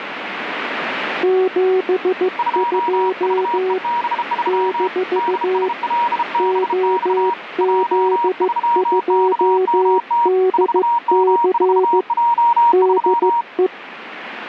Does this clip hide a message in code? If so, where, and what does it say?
Yes: Morse code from 1.2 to 13.7 s, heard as two keyed tones, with radio static. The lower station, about 15 wpm, 370 Hz: 72 - OZ2DC DE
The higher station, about 33 wpm, 950 Hz: 2VEB3 DSLBX J3KMT 4M4J3